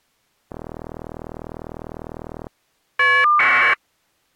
Caller ID data burst, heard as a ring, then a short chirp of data, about 1200 baud.